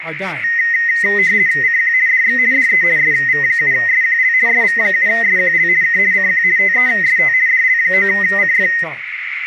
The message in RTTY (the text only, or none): CQ DX DE SV7SQL SV7SQL K CQ TEST DL9CF